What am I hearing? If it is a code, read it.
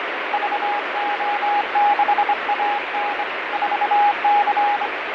Morse code, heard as a keyed tone, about 25 wpm, 820 Hz, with heavy radio static and fading. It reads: VO6AN 4C